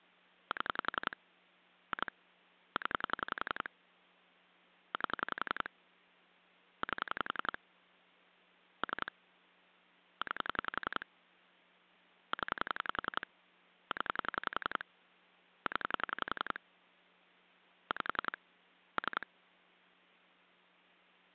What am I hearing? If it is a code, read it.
Pulse dialling, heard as clicks on a phone line, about 11 pulses a second. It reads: 7 2 0 8 8 3 9 0 0 0 5 3